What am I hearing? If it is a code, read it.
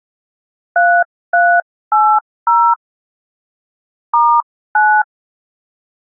DTMF, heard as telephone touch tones, dialled by hand, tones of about 270 ms. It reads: 3380 *9